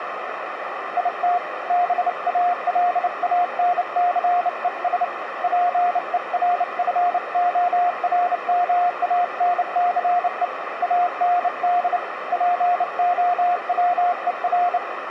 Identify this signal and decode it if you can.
Morse code, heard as a keyed tone, hand-sent with a bug key, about 29 wpm, 710 Hz, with radio static and a narrow filter. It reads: IT BALANCES PERFORMANCE AND POWER